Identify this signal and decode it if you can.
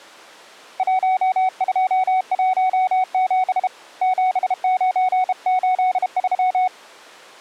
Morse code, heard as a keyed tone, hand-sent with a bug key, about 32 wpm, 740 Hz. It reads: 1217 7983